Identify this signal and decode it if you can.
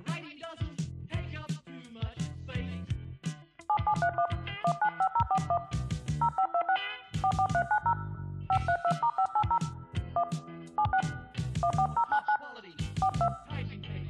DTMF, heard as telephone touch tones, dialled by hand, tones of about 70 ms. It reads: 7731 195041 0526 44390 532*580 1 76 14099 42